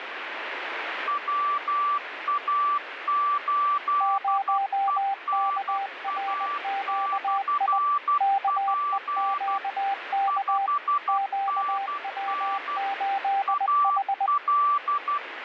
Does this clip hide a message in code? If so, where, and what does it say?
Yes: Morse code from 1.0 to 15.2 s, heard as two keyed tones, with radio static. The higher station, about 12 wpm, 1160 Hz: WA8ENA/P 5NN AL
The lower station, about 20 wpm, 790 Hz: 0KRQI KEQK QW8H